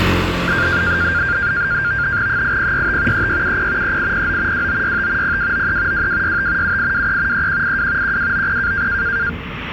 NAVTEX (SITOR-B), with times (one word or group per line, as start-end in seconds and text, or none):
2.3-3.3 8065
3.1-4.0 3670
3.8-4.7 3809
4.5-5.4 2965
5.2-6.1 0293
5.9-6.8 2265
6.6-7.5 7823
7.3-8.2 3182
8.0-8.9 1290